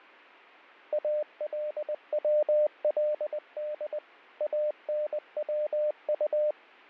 Morse code (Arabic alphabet), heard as a keyed tone, machine-sent, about 20 wpm, 600 Hz, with fading. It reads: الولد انوط